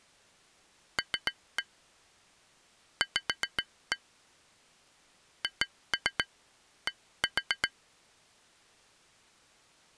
Tap code, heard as taps on glass, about 7 knocks a second. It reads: L V HD